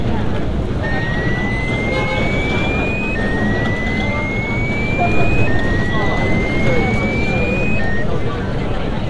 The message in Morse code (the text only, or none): none